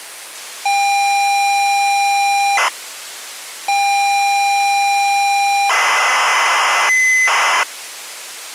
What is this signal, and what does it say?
ZX Spectrum tape loading, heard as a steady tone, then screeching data.